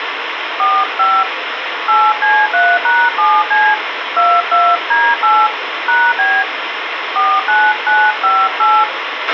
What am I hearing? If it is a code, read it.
DTMF, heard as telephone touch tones, dialled by hand, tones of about 240 ms, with radio hiss and a squelch burst at the end. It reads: 45 8C3#7C 22D8 #B 49958